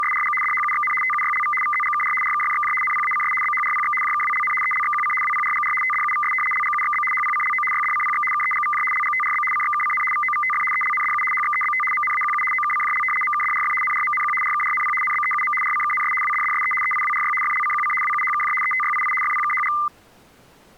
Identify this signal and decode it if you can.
RTTY (75 baud, 850 Hz shift), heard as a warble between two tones, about 1600 Hz centre. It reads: … DHUXN TUYLV VZGKR RKFXJ NPACS BHRPX JKWLN ELXQC WPRGR TDUVS LGUXB HPCLO YDCPX KEGVJ LGTRB CXKCN VOVTF ELNDU HXEBT MNAQU OKCJL MKDRF NRMNQ RKRNP NBEUM RCKNS WDDSE EIWRY FLCQC WUHKJ ETYII FPKHG